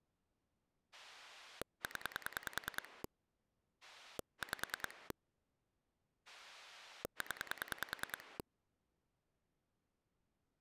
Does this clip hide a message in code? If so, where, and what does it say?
Yes: pulse dialling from 0.9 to 8.4 s, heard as a rotary dial, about 10 pulses a second. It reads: 0 5 0